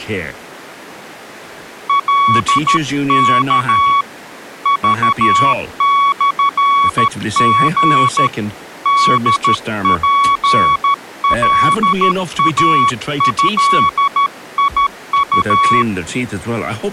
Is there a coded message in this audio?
Yes: Morse code (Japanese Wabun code) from 1.8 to 15.9 s, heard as a keyed tone, hand-sent with a paddle, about 13 wpm, 1120 Hz, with speech in English. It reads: カワ クモリ ホツカイドウ